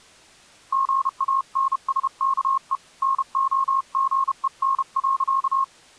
Morse code, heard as a keyed tone, hand-sent with a paddle, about 32 wpm, 1080 Hz. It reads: GANSKE NOGEN.